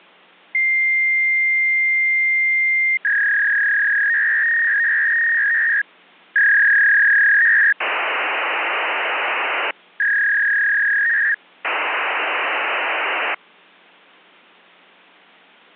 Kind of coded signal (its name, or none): fax machine handshake